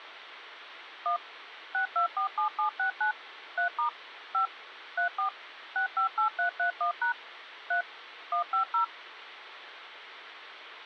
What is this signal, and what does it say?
DTMF, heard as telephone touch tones, dialled by machine, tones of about 110 ms, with radio hiss. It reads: 1 6247769 3* 5 34 658331# 3 150